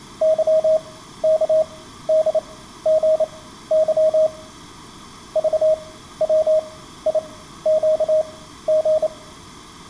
Morse code (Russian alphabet), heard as a keyed tone, machine-sent, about 28 wpm, spaced as for 14 wpm, 630 Hz. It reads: ЫКДГЫ ЖВИЩГ